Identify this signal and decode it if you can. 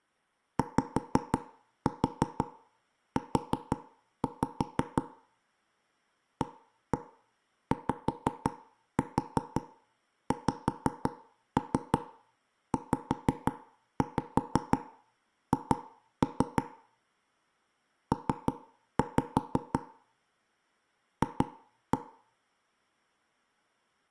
Tap code, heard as knocks on wood, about 5 knocks a second, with room echo. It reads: YU AYXZH P F